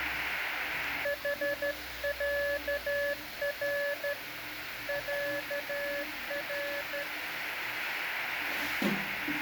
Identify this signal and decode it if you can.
Morse code (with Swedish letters), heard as a keyed tone, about 13 wpm, 570 Hz, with radio static and the noise of a restroom. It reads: HÄR ÄR